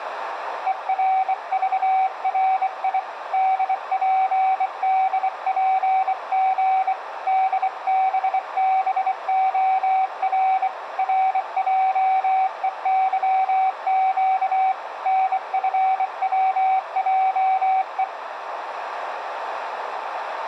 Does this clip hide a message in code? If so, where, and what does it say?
Yes: Morse code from 0.6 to 18.1 s, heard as a keyed tone, hand-sent with a bug key, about 24 wpm, 760 Hz, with radio static, a narrow filter and room echo. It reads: ERVRI DPDPG DBBOR RJEYQ NFWJE